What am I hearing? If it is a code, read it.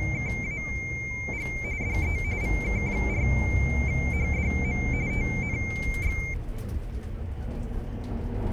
RTTY (45.45 baud, 170 Hz shift), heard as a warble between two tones, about 2200 Hz centre, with the noise inside a bus. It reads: … DE VK4HDM TNX